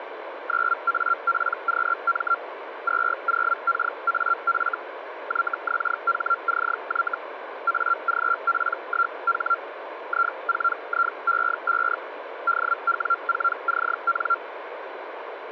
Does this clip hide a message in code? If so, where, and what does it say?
Yes: Hellschreiber (Feld-Hell, 122.5 baud) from 0.5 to 14.4 s, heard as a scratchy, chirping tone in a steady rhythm, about 1380 Hz, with radio static. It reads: 9APQM 20KAF YXHCY AGP1H I4IE5 DW4CN